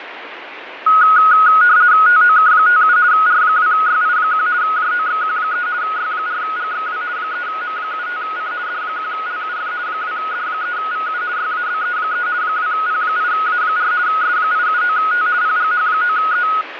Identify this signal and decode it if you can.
RTTY (50 baud, 170 Hz shift), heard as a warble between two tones, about 1360 Hz centre, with radio static and fading. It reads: TOK57 R2YI1 JOXQ3 Y4GXW 3M75C D1LUF 2D3VU YABE3 2P8A4 S879T PGH9E